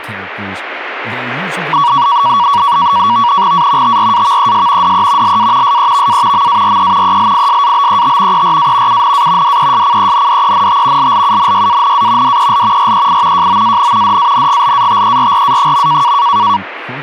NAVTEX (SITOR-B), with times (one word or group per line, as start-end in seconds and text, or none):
3.5-4.0 A
3.8-4.9 TRAVES
4.8-5.4 DE
5.2-5.8 LA
5.6-6.5 SEVA
6.3-7.2 MARE
7.0-8.4 ELISABET
8.3-9.0 ERA
8.9-9.6 UNA
9.4-11.1 DESCENDENT
11.0-12.4 LLUNYANA
12.2-12.9 DEL
12.8-13.5 REI
13.3-14.2 JOAN
14.0-16.1 DANGLATERRA.